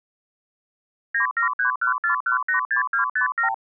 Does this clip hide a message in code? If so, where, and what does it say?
Yes: multi-frequency trunk signalling (R2, with the far end's replies) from 1.1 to 3.5 s, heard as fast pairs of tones, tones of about 110 ms. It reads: 97314186257